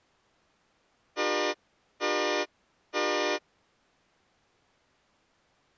Train horn signal, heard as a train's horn. 3 short. On North American railways: when stopped, the train will back up.